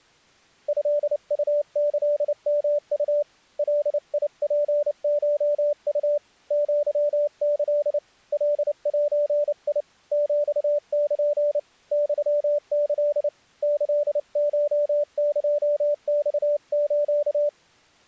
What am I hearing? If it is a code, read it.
Morse code (Japanese Wabun code), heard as a keyed tone, hand-sent with a paddle, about 29 wpm, 590 Hz. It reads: トウキヨウ ガツコウ アキ カゼ ヒル ユキ キコエマス